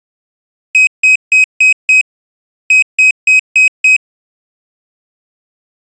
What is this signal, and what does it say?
Beep code, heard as a piezo beeper, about 2550 Hz. 5-5.